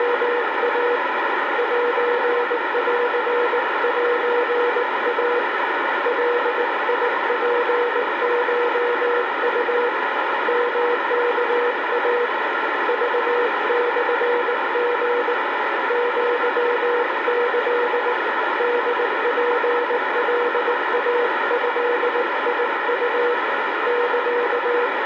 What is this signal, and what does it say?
Morse code (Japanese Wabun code), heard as a keyed tone, hand-sent with a paddle, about 19 wpm, 480 Hz, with heavy radio static. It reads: … センセイ ガツコウ ヨワイ クモリ アキ ホツカイドウ …